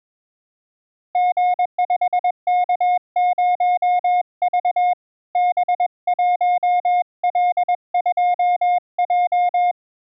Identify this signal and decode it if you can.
Morse code, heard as a keyed tone, hand-sent with a paddle, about 21 wpm, 720 Hz. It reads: G5K0V B1L2J